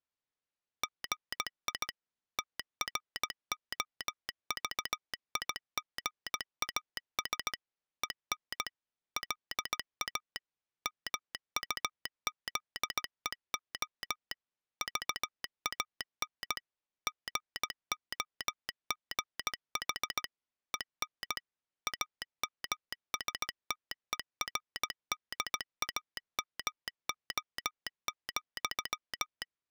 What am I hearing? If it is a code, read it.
Morse code, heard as a telegraph sounder, machine-sent, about 17 wpm. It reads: GI TROVIGAS EN LA MUZEO VAN GOGH EN AMSTERDAMO,